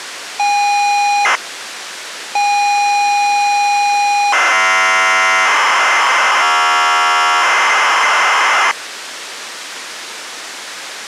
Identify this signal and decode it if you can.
ZX Spectrum tape loading, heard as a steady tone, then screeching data, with tape hiss.